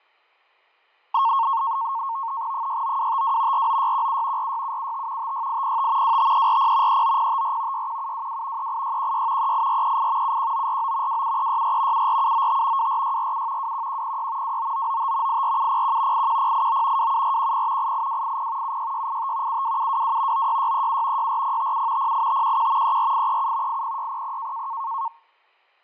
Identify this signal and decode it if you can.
NAVTEX (SITOR-B), 100 baud, 170 Hz shift, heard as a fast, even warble, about 1000 Hz centre, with fading. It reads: 69252 49617 46775 56805 25340 39054 61722 38616 38438 71949 27364 74795 24647 21106 29995 84701 81089 27410 88280 76685 72722 96637 64057 08511 34837 80600